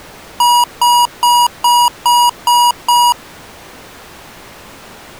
Beep code, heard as beeps from a small speaker, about 960 Hz. 7 short. In AMI BIOS tables: virtual mode exception error; in Dell tables: processor failure.